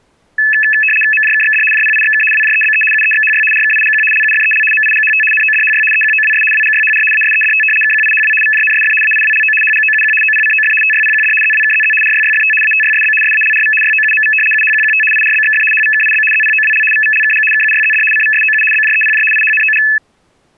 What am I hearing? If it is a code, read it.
RTTY (75 baud, 850 Hz shift), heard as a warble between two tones, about 2150 Hz centre. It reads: MJKXD JPIXK WJEBE UEXHY RKIGQ LUFEL MIGHT NODHY EQOWS WGYHR ASEDT KQIHW VJNSF AIWLO HGOUQ OPCOF TYPQD ZWKZZ RYYFT ATYSB SALRV YOUMV UHQQT IRBXF HVKIB ZPOWL VVLKG KUYZD CVSOU BJEPJ IHNOG